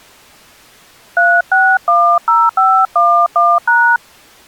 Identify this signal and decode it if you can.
DTMF, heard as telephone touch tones, dialled by hand, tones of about 280 ms. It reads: 3610511#